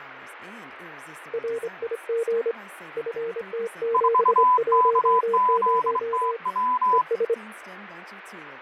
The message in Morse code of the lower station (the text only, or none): RIG FT710 ES